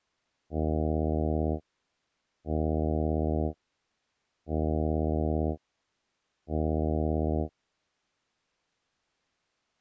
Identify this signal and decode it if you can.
Ship horn signal, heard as a ship's horn, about 80 Hz. 4 short. At sea: a pilot vessel's identity signal in fog.